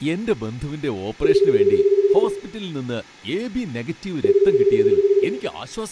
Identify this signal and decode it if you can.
Telephone call progress tone (Japanese plan), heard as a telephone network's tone, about 380, 400, 420 Hz, 1 s on and 2 s off, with room echo and speech in Malayalam. Ringback tone.